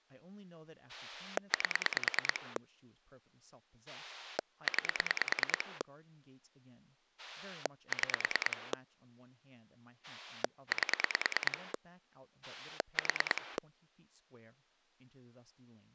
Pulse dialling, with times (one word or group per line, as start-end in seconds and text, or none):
0.9-2.6 8
3.9-5.8 9
7.2-8.7 6
10.0-11.7 8
12.4-13.6 4